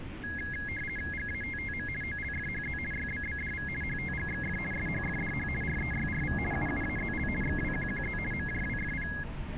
RTTY (50 baud, 450 Hz shift), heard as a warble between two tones, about 1900 Hz centre, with radio static and street noise. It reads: GATTM OLFHZ YBBDV HTGXF SHFDH REYRV UUAZL XWQQZ MJWFP